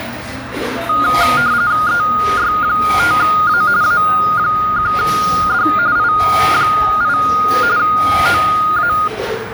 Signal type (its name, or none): RTTY